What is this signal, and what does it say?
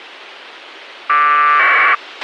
Packet radio (AX.25, as in APRS), 1200 baud, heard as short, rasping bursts, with a squelch burst at the end.